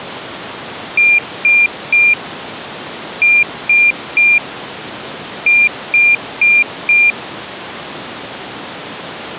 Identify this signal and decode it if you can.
Beep code, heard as a piezo beeper, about 2400 Hz. 3-3-4. In Phoenix BIOS tables: video failure.